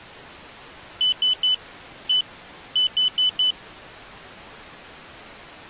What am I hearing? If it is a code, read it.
Beep code, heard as a piezo beeper, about 3000 Hz. 3-1-4. In Phoenix BIOS tables: interrupt mask register failure.